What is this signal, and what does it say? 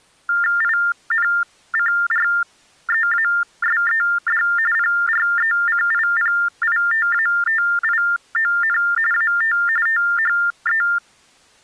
TTY/TDD text telephone tones (45.45 baud Baudot), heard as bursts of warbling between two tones, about 400 Hz shift, 1600 Hz centre. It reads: INCREASED PRECIPITATION AT THE